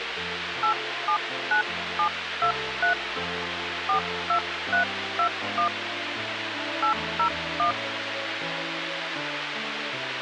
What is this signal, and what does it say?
DTMF, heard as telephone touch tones, dialled by hand, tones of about 90 ms, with radio hiss. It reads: 879723 42321 801